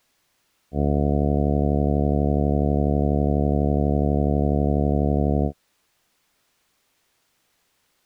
Ship horn signal, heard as a ship's horn, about 70 Hz. 1 long. At sea: a vessel nearing a blind bend, or under power and making way in fog.